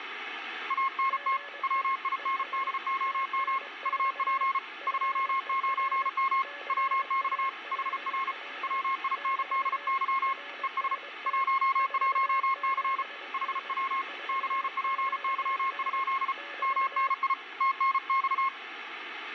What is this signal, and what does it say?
Morse code, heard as two keyed tones, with radio static. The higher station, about 34 wpm, 1080 Hz: ANT WINDOM UP 29M WX HR WINDY ES 11C HW CPY? MNI TNX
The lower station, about 22 wpm, 570 Hz: GE ES TNX FER CALL <BT> RST 47N 47N <BT>